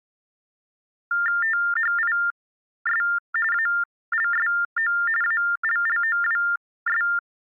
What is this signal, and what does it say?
TTY/TDD text telephone tones (45.45 baud Baudot), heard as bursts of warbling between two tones, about 400 Hz shift, 1600 Hz centre. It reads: THIS ALSO ALLOWS